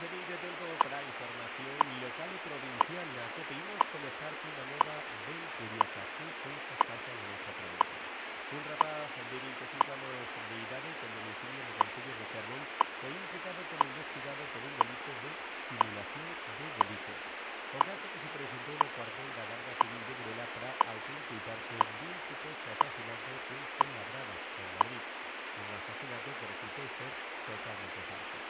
Radio time signal (WWV, Colorado), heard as ticks, one a second, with radio static.